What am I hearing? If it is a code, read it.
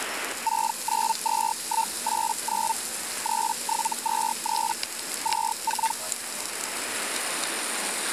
Hellschreiber (Feld-Hell, 122.5 baud), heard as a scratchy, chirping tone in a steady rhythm, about 900 Hz, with radio static and the noise of a restaurant. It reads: 692189 3723 24